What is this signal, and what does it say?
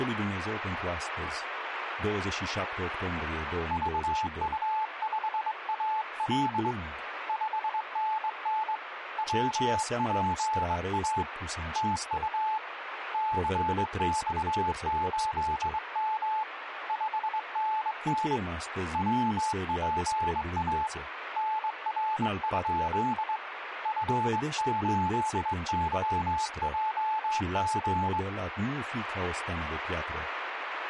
Morse code, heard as a keyed tone, hand-sent with a straight key, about 22 wpm, 870 Hz, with radio static and speech in Romanian. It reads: VU5AL 5NN WPA TU CX8M 5NN WPA NR? F8YJG